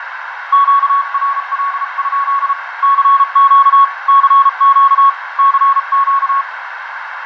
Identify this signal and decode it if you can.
Morse code, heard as a keyed tone, hand-sent with a paddle, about 34 wpm, 1110 Hz, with radio static, fading, a narrow filter and room echo. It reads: QRL? CQ CQ CQ